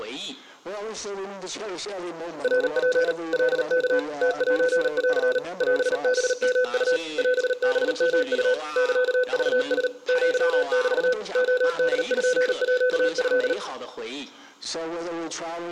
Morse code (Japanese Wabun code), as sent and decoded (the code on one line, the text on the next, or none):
.-. .--. / .-.. -.- / - .---. .-.-. / .-... -... -- ..- / .-... -... -- ..- / -.-.- ...- ... / --.-- -...- / --- -.. ..--. .--.- ..-..
ナツ カワ ムセン オハヨウ オハヨウ サクラ アメ レポート